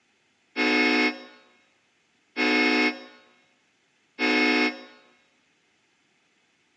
Train horn signal, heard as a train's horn, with room echo. 3 short. On North American railways: when stopped, the train will back up.